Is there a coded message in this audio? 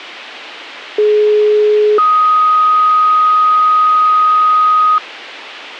Yes: two-tone page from 1.0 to 5.0 s, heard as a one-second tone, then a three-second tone, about 420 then 1250 Hz.